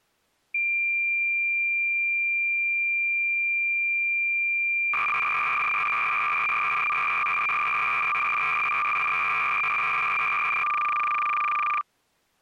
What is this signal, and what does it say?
Cassette data (Kansas City type), 300 baud, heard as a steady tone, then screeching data.